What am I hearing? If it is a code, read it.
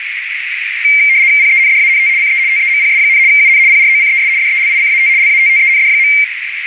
RTTY (75 baud, 170 Hz shift), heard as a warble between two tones, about 2200 Hz centre, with radio static and a narrow filter. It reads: PENDANT CE TEMPS, UN PROCES DELICAT LATTEND.